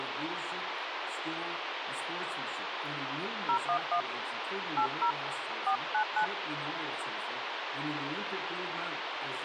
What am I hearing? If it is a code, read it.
DTMF, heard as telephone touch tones, dialled by hand, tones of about 90 ms, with radio hiss. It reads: 011 80 499